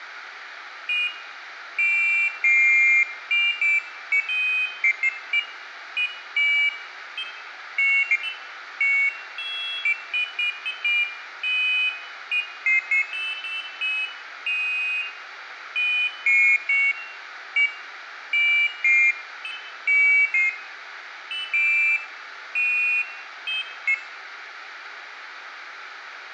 Pairs of high tones at irregular times, with radio hiss and room echo. There is no code.